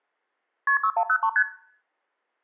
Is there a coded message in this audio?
Yes: multi-frequency trunk signalling (R1, as on North American trunks) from 0.7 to 1.4 s, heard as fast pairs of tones, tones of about 70 ms, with room echo. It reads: KP 6103 ST